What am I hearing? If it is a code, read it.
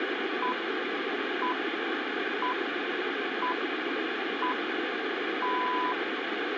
Radio time signal (six pips, as the Greenwich Time Signal), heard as pips, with radio static and room echo.